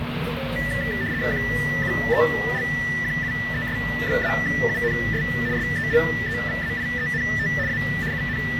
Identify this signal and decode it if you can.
RTTY (75 baud, 170 Hz shift), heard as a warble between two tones, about 1850 Hz centre, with radio static and the noise of a crowd indoors. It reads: QUELQUES-UNS SELEVAIENT A …